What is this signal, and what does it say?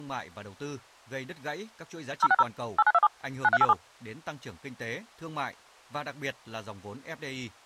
DTMF, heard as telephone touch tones, dialled by machine, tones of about 40 ms, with speech in Vietnamese. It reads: 060 8927 9387